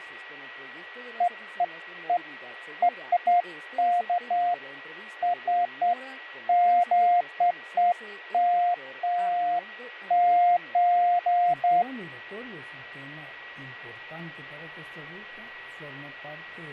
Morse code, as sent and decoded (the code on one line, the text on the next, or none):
none